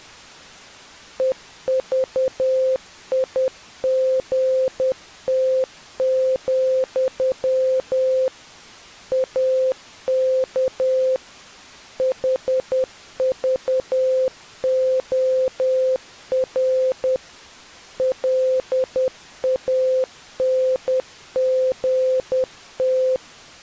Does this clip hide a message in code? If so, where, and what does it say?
Yes: Morse code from 1.1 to 23.2 s, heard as a keyed tone, machine-sent, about 10 wpm, 520 Hz. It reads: EVIGT, AK HVOR LANGT